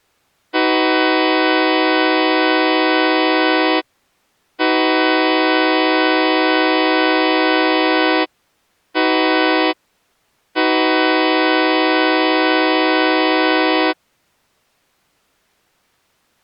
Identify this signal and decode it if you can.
Train horn signal, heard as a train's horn. 2 long, 1 short, 1 long. On North American railways: approaching a public crossing.